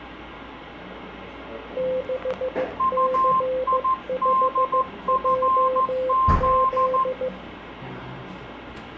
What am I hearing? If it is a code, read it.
Morse code, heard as two keyed tones, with radio static and the noise of a cafe. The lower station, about 15 wpm, 520 Hz: 6C5JZ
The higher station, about 14 wpm, 1050 Hz: UIDFZ